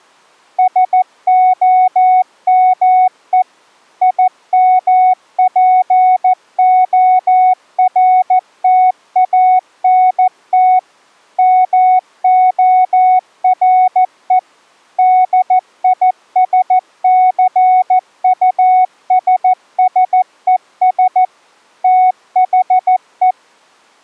Morse code, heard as a keyed tone, machine-sent, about 14 wpm, 740 Hz. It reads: SOME IMPORTANT MORE DISCUSSES THE